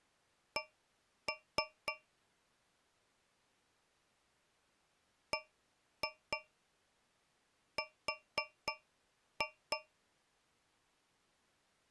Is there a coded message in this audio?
Yes: tap code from 0.6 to 9.9 s, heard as taps on a metal pipe, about 3 knocks a second. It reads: C BR